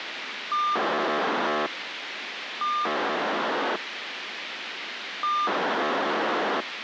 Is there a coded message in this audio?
Yes: POCSAG pager data (2400 baud) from 0.5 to 6.6 s, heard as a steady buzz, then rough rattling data, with radio hiss.